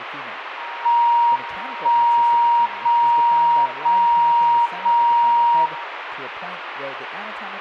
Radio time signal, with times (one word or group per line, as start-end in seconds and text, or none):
0.9-1.9 1
1.9-2.9 0
2.9-3.9 0
3.9-4.9 0
4.9-5.9 0